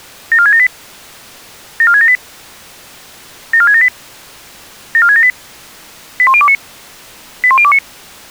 Five-tone selective call (ZVEI), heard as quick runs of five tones, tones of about 70 ms. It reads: 74678 74678 74678 74678 81029 81029